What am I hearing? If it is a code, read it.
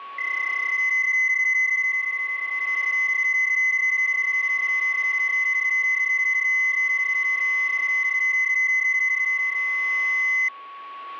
PSK31 (31.25 baud), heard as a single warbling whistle, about 2050 Hz, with a steady whistle near 1120 Hz.